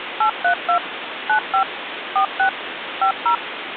DTMF, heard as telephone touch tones, dialled by machine, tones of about 100 ms, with phone line noise. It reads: 832 95 46 50